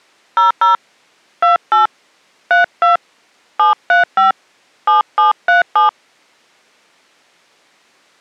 DTMF, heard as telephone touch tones, dialled by hand, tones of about 140 ms. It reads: 00 28 32 735 7737